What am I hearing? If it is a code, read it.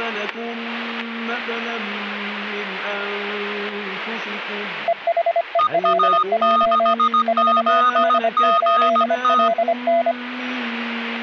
Morse code, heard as two keyed tones, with static crashes. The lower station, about 25 wpm, 680 Hz: EHELJ 4D8LN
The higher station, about 17 wpm, 1240 Hz: EA6ZGT